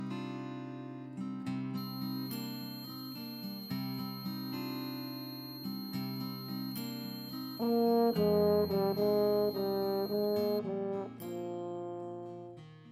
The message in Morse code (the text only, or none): none